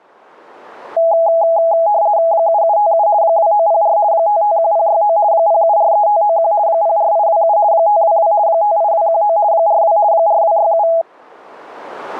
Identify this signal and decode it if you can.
RTTY (50 baud, 170 Hz shift), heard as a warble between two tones, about 750 Hz centre. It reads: 7757 2904 551069 0743591 04827 522 58219 42 4267